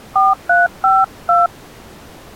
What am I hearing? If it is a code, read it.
DTMF, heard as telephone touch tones, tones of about 180 ms. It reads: 4352